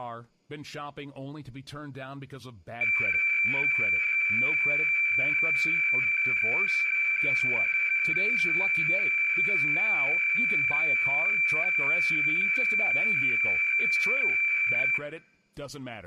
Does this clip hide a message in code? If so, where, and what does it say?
Yes: weather fax (radiofax), 120 lines a minute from 2.8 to 15.0 s, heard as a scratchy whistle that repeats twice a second, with room echo and speech in English.